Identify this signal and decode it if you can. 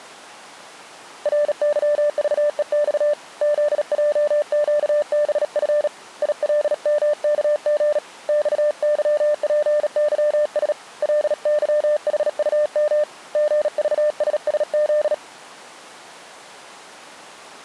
Morse code, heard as a keyed tone, hand-sent with a bug key, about 37 wpm, 600 Hz. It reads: RYVEX ZJQBF ILMKG XYPYS LYHUM GVSSZ